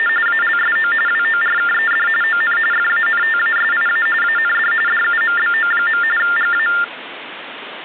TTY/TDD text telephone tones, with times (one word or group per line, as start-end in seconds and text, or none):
0.0-0.1 …
0.3-0.9 ALSO
1.1-2.1 WORKED
2.2-2.6 ON
2.7-4.1 FANTASIA
4.2-4.7 AND
4.9-6.0 DUMBO.
6.2-6.7 GA